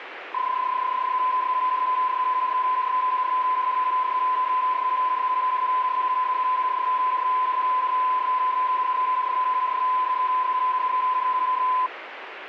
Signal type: PSK31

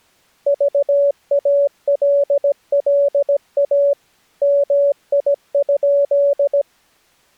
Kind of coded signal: Morse code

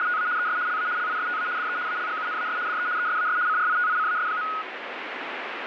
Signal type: RTTY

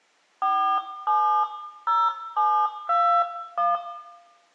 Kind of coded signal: DTMF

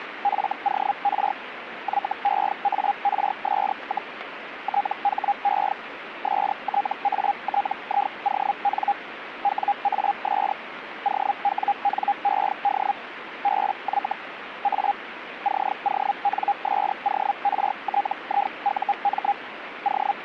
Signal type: Hellschreiber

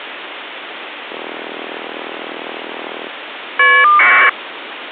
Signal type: caller ID data burst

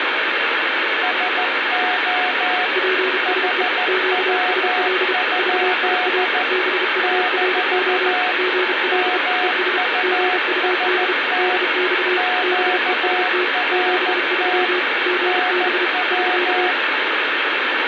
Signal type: Morse code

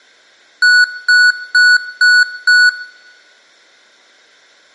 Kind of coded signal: beep code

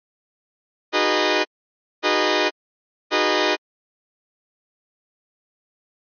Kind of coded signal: train horn signal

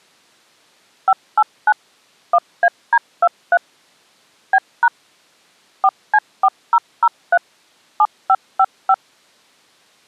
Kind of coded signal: DTMF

